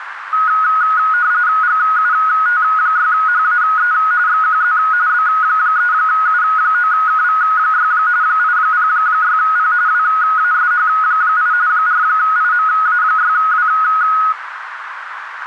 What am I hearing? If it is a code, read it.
RTTY (45.45 baud, 170 Hz shift), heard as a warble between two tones, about 1360 Hz centre, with radio static and a narrow filter. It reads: GUT6HAE XQZ B3U9KV6 806P WASH8 4IMA6W